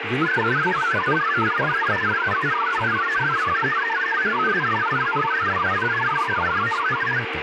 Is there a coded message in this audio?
Yes: multi-tone FSK (Olivia or MFSK type), about 1000 Hz wide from 0.2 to 7.2 s, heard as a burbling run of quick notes, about 62.5 baud, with radio static, room echo and speech in Kashmiri.